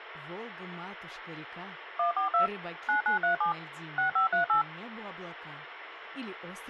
DTMF, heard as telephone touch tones, dialled by machine, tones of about 120 ms, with phone line noise. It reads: 142 9937 6538